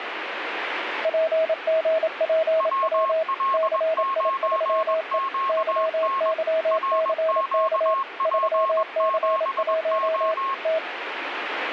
Morse code, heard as two keyed tones, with radio static. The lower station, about 27 wpm, 640 Hz: PGPW CI3E YYCK 3C1 T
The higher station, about 21 wpm, 1080 Hz: WL9QN RQP7O